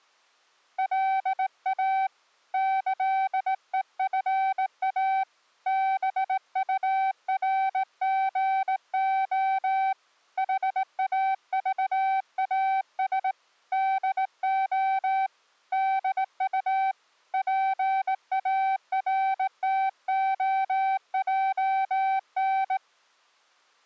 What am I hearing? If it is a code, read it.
Morse code (with Esperanto letters), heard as a keyed tone, hand-sent with a straight key, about 18 wpm, 770 Hz. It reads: LA ĈEFA BURGO HAVAS DO DU PARTOJN